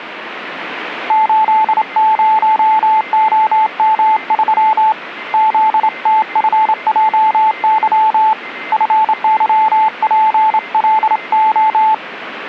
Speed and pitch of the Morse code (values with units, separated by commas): 27 wpm, 870 Hz